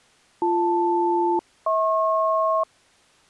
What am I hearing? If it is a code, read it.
Aircraft SELCAL, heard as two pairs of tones. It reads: BL-HP